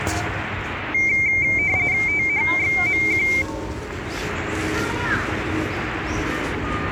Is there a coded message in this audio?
Yes: RTTY (45.45 baud, 170 Hz shift) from 0.9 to 3.4 s, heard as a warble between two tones, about 2200 Hz centre, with the noise of a park. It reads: THXMQ